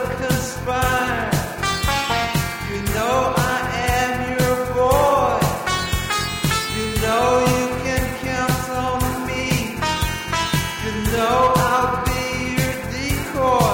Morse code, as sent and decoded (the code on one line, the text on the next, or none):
none